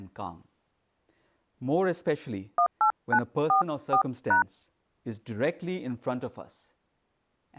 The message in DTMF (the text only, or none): 18944#